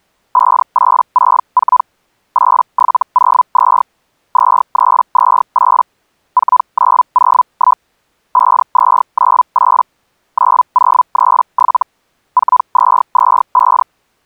Hellschreiber (Feld-Hell, 122.5 baud), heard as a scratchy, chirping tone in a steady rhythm, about 1000 Hz. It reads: 5864 8702 2328 4901 5298 9037 4225